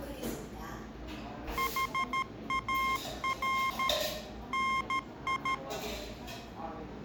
Morse code, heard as electronic beeps, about 13 wpm, 1060 Hz, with room echo and the noise of a cafe. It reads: HAR NI